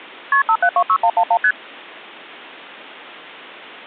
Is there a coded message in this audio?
Yes: multi-frequency trunk signalling (R1, as on North American trunks) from 0.3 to 1.5 s, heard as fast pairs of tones, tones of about 70 ms. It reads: KP 5726111 ST